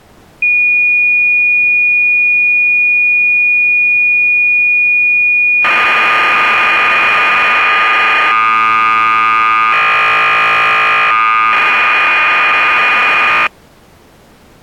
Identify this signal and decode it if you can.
Cassette data (Kansas City type), 1200 baud, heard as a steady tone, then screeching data.